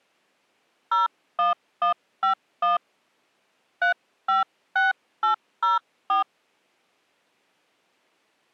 DTMF, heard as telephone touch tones, dialled by hand, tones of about 140 ms. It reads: 01151 356804